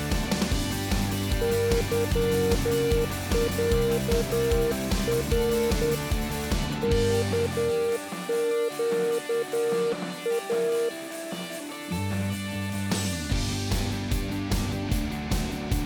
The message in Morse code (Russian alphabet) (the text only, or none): ЫЯР КЩА